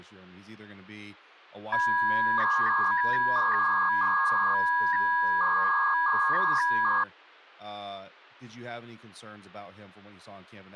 300-baud modem data (V.21 tones), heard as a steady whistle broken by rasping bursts, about 300 baud, 200 Hz shift, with speech in English.